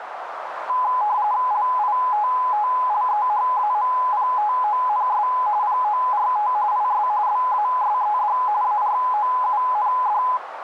RTTY (45.45 baud, 170 Hz shift), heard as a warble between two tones, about 920 Hz centre, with radio static and a narrow filter. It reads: LITTLEHAMPTONS PORT IS BASED AROUND